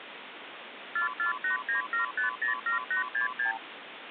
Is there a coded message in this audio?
Yes: multi-frequency trunk signalling (R2, with the far end's replies) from 1.0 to 3.6 s, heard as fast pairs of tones, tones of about 120 ms, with phone line noise. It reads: 44897507866